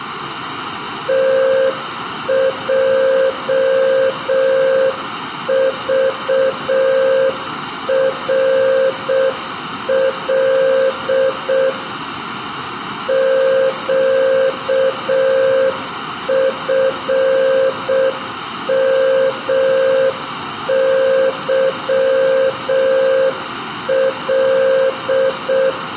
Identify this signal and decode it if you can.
Morse code, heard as a keyed tone, machine-sent, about 6 wpm, 530 Hz, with room echo. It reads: TJVRL QFMYL